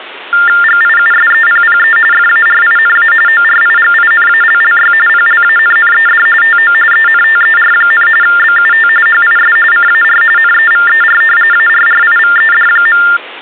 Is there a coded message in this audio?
Yes: TTY/TDD text telephone tones (45.45 baud Baudot) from 0.3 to 13.2 s, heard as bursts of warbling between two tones, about 400 Hz shift, 1600 Hz centre. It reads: GIUSEPPE FARINA ORIGINALLY PLANNED TO ENTER, BUT HIS CAR NEVER ARRIVED.